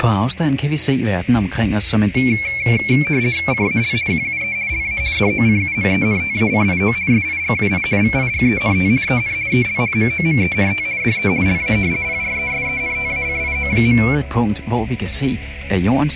RTTY (50 baud, 170 Hz shift), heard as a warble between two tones, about 2250 Hz centre, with radio static. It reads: CAL QUE LA DOCUMENTACIO SIGUI VIGENT EN EL MOMENT DE LA PRESENTACIO.